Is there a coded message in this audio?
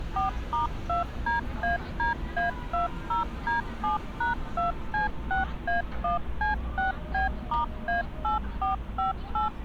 Yes: DTMF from 0.2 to 9.5 s, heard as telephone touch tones, dialled by machine, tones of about 140 ms, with street noise. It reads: 4*2DADA20D7#2C6A1C6B*A8458